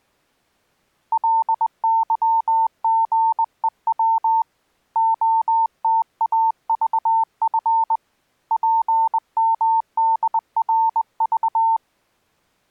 Morse code, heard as a keyed tone, hand-sent with a straight key, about 20 wpm, 900 Hz. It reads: LYGEW OTAVF PMDRV